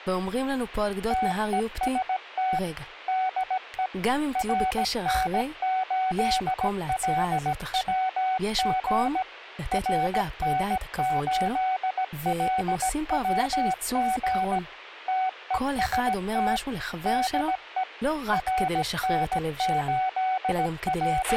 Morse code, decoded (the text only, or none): TEST DE RN8LWG RN8LWG TEST DE …